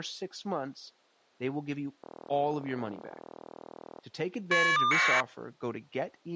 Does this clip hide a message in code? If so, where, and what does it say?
Yes: caller ID data burst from 2.0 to 5.2 s, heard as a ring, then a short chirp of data, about 1200 baud, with speech in English.